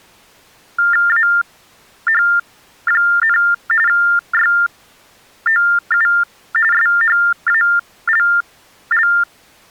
TTY/TDD text telephone tones (45.45 baud Baudot), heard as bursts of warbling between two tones, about 400 Hz shift, 1600 Hz centre. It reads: AH, YOU SHALL